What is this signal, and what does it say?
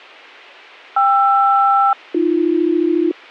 Aircraft SELCAL, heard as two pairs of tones. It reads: KR-AB